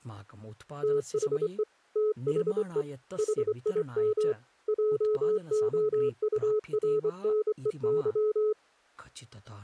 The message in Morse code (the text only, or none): THE THE HIM JOURNEY